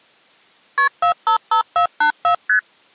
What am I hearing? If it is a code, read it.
Multi-frequency trunk signalling (R1, as on North American trunks), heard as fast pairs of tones, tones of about 100 ms. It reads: KP 455484 ST